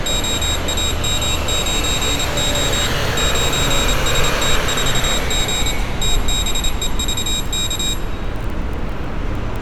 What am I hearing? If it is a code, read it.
Morse code, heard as a high beeper, machine-sent, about 27 wpm, 3800 Hz, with room echo and street noise. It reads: OAM9O 9ST4G TBEVK